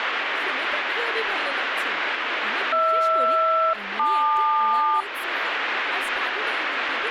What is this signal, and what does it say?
Aircraft SELCAL, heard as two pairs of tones, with radio static and speech in Bangla. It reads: HR-LQ